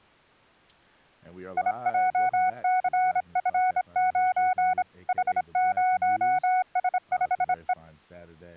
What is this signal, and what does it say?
Morse code, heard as a keyed tone, hand-sent with a straight key, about 26 wpm, 740 Hz, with speech in English. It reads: IJCF9 H0S5E